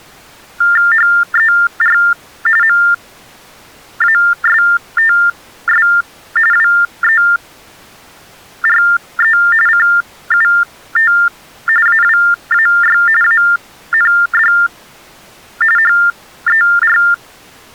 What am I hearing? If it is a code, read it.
TTY/TDD text telephone tones (45.45 baud Baudot), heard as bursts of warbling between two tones, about 400 Hz shift, 1600 Hz centre. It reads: HER MASTS WERE CUT AWAY AND HER